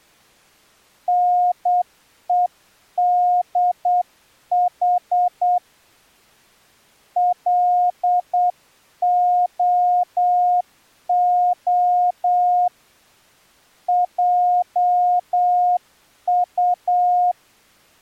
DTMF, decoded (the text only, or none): none